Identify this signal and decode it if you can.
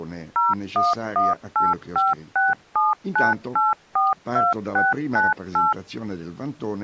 DTMF, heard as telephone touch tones, dialled by machine, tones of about 180 ms. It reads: 01185679842698